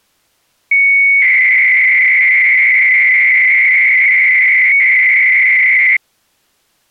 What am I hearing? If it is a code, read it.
300-baud modem data (Bell 103 tones), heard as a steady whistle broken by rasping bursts, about 300 baud, 200 Hz shift.